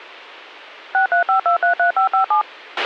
DTMF, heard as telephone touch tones, dialled by machine, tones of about 110 ms, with a squelch burst at the end. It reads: 635233557